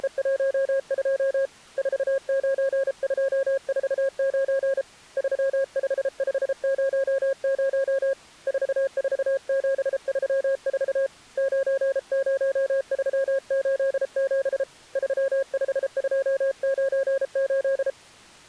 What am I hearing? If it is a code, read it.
Morse code, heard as a keyed tone, hand-sent with a paddle, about 33 wpm, 540 Hz. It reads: … 49249 35500 44734 90387 35298